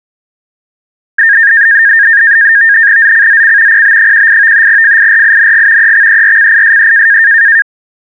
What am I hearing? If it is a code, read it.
NAVTEX (SITOR-B), 100 baud, 170 Hz shift, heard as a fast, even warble, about 1700 Hz centre. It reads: ZCZC PB18 FIRING EXERCISE